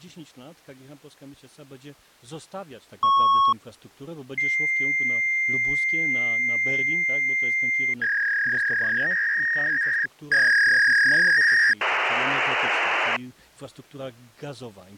Fax machine handshake, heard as a beep, a long tone, a warble and hiss.